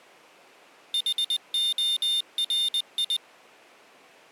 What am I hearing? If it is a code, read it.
Morse code, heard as a high beeper, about 20 wpm, 3600 Hz. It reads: HORI